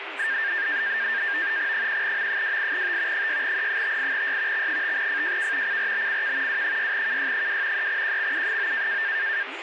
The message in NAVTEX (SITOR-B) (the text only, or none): 1M28T 6E58Y X5FJK CRBCK W6KY2 3QXU9